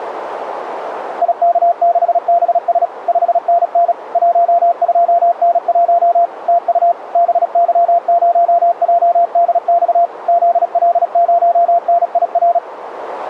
Morse code, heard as a keyed tone, machine-sent, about 36 wpm, 690 Hz, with radio static. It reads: IK6BS 5NN 12N1 TU BY0JDX ZL0NIR